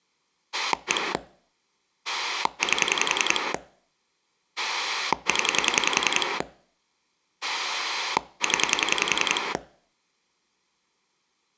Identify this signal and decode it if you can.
Pulse dialling, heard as a rotary dial, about 10 pulses a second. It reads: 1 8 0 0